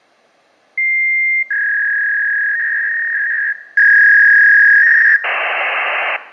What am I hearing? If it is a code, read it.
Fax machine handshake, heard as a long tone, a warble and hiss.